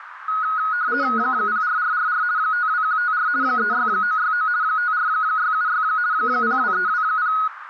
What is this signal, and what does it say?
RTTY (50 baud, 170 Hz shift), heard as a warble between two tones, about 1360 Hz centre, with radio static and a narrow filter. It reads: 04444 52154 36969 54676 02320